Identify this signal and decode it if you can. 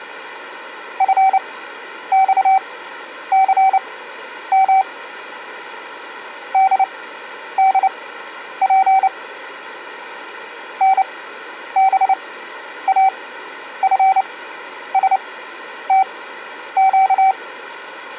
Morse code, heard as a keyed tone, machine-sent, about 29 wpm, spaced as for 10 wpm, 770 Hz. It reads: FXCM DDP NBAFSTQ